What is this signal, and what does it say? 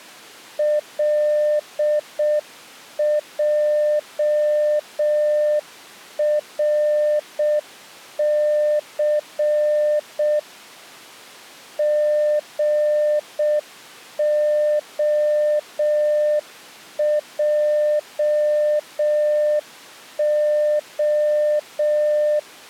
Morse code, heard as a keyed tone, machine-sent, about 6 wpm, 600 Hz. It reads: LJRC GOJO